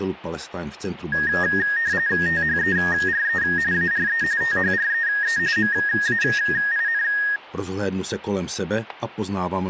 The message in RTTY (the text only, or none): THERE ARE THREE MAIN